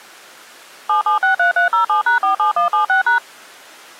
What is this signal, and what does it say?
DTMF, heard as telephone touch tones, dialled by machine, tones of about 120 ms. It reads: 7763307#47176#